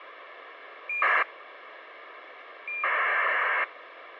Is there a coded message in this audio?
Yes: ACARS aircraft data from 0.9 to 3.6 s, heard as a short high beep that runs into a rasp, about 2400 baud, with radio hiss.